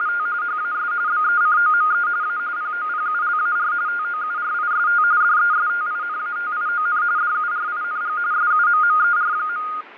RTTY (45.45 baud, 170 Hz shift), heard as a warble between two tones, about 1330 Hz centre, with radio static and fading. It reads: … HAS BECOME A POPULAR TOURIST DESTINATION DURING SUMMER.